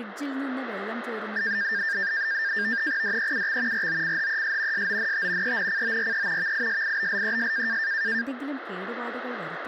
NAVTEX (SITOR-B), 100 baud, 170 Hz shift, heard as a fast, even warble, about 1700 Hz centre, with radio static and speech in Malayalam. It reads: DEUX ROCHES SONT ENCORE VISIBLES